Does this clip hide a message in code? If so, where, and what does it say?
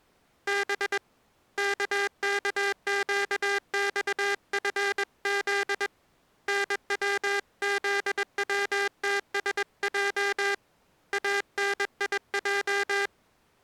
Yes: Morse code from 0.4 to 13.1 s, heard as a buzzer, hand-sent with a paddle, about 21 wpm. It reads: B KKQXFZ NWZWTSJ ANIJ